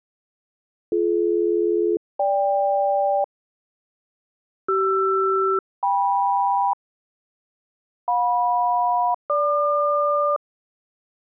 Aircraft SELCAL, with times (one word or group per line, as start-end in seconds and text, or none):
0.9-3.2 BD-GK
4.7-6.7 CR-KM
8.1-10.4 JM-GQ